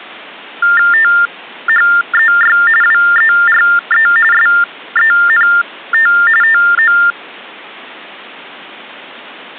TTY/TDD text telephone tones (45.45 baud Baudot), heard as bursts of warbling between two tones, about 400 Hz shift, 1600 Hz centre. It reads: THEY WERE SENT TO